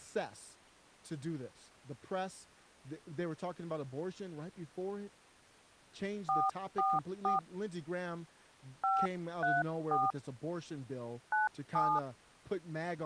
DTMF, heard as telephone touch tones, dialled by hand, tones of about 190 ms, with speech in English. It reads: 444 534 97